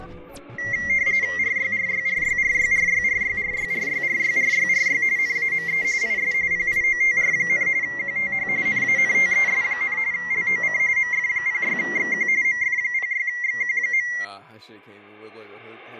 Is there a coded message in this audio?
Yes: RTTY (45.45 baud, 170 Hz shift) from 0.6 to 14.2 s, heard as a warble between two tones, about 2050 Hz centre, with static crashes. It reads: RYRYRYRYRYRYRYRYRYRYRY NAME IS PIOTR, QTH NANTES, LOC MF06XQ MF06XQ.